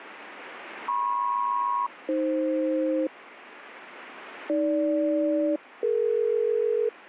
Aircraft SELCAL, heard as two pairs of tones, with radio static. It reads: MP-AF AG-DE